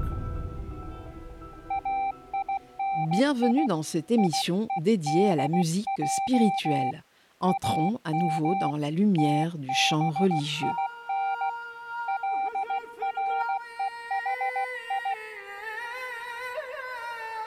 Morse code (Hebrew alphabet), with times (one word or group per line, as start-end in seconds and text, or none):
1.7-3.7 איני
4.2-6.9 יודע
7.5-8.7 אם
9.2-11.5 תבין
12.1-15.1 לרוחי